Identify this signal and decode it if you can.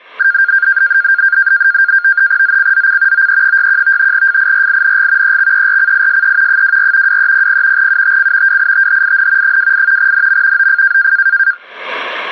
NAVTEX (SITOR-B), 100 baud, 170 Hz shift, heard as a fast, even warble, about 1500 Hz centre. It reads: ZCZC OE61 FIRING EXERCISE 24 2300 UTC WITHIN 28 NM OF